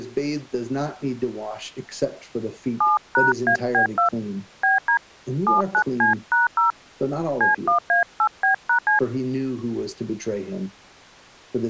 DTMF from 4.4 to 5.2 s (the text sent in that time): BD